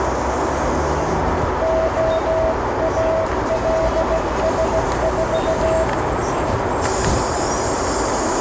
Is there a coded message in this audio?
Yes: Morse code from 1.6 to 5.9 s, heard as a keyed tone, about 16 wpm, 650 Hz, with heavy radio static, a narrow filter and street noise. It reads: OALS4